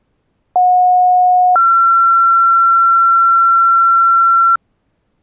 Two-tone page, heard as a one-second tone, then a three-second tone, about 730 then 1360 Hz.